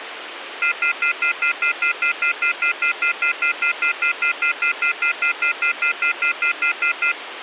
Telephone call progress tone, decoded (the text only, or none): off-hook warning tone